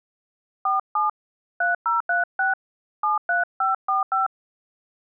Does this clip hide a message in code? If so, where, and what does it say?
Yes: DTMF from 0.7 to 4.3 s, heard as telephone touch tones, dialled by hand, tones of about 150 ms. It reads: 47 3036 73545